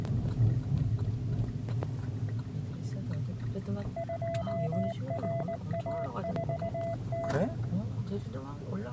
Morse code, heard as a keyed tone, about 19 wpm, 670 Hz, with the noise inside a car. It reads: 2RA4T